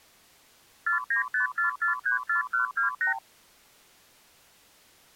Multi-frequency trunk signalling (R2, with the far end's replies), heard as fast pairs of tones, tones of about 120 ms. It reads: 4954434128